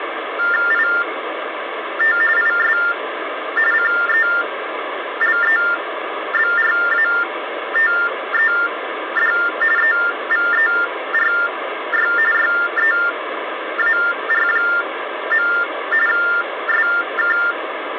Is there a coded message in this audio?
Yes: TTY/TDD text telephone tones (45.45 baud Baudot) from 0.4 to 17.5 s, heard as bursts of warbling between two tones, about 400 Hz shift, 1600 Hz centre, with phone line noise. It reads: IT IS CELEBRATED EVERY YEAR. SK